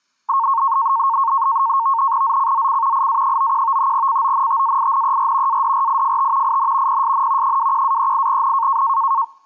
NAVTEX (SITOR-B), 100 baud, 170 Hz shift, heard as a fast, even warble, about 1000 Hz centre. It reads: ZCZC IA91 CONTAINER ADRIFT IN PSN 21-38N